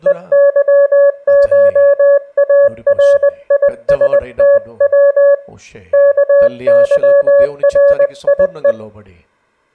Morse code (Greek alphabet), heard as a keyed tone, hand-sent with a paddle, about 20 wpm, 560 Hz, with room echo and speech in Tamil. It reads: ΕΥΧΑΡΙΣΤΩ ΚΥΡΙΕ